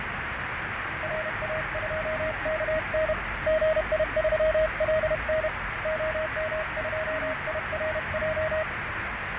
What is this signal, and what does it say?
Morse code, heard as a keyed tone, hand-sent with a paddle, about 31 wpm, 630 Hz, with radio static, fading and the noise inside a car. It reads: RA2KN GI3LN OM2IRJ